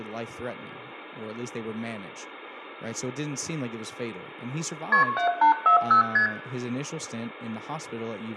Multi-frequency trunk signalling (R1, as on North American trunks), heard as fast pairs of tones, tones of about 110 ms, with room echo and speech in English. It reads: KP 7840 ST